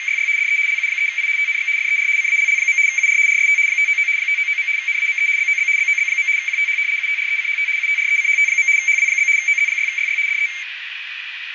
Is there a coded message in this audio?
Yes: RTTY (75 baud, 170 Hz shift) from 0.0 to 10.6 s, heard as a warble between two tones, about 2200 Hz centre, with radio static and a narrow filter. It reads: … DE LU3I TNX FER CALL. UR RST 599 599. NAME BOB BOB. QTH UTRECHT UTRECHT. HW? OZ6YY DE